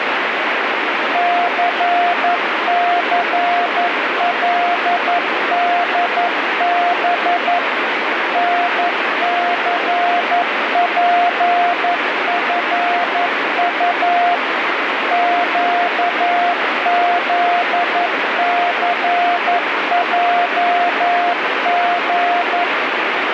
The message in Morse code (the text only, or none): CCLDB NCPFU QZCJG